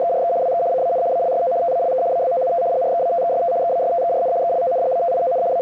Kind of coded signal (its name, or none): RTTY